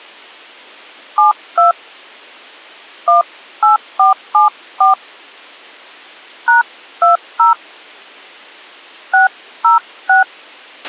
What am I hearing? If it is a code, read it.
DTMF, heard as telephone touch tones, dialled by hand, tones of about 140 ms, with a squelch burst at the end. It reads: 72 18474 #20 606